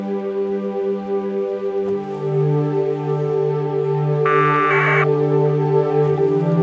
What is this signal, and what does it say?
Packet radio (AX.25, as in APRS), 1200 baud, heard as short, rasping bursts.